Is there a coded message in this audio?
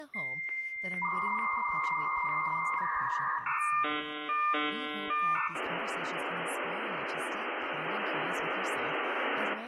Yes: dial-up modem handshake (V.34 or later) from 0.1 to 9.5 s, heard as a whistle, warbles, then hiss, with room echo and speech in English.